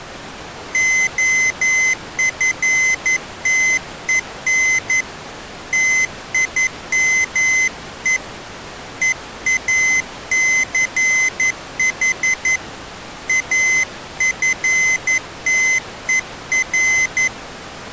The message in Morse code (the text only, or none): OFTEN TIME EACH AFTER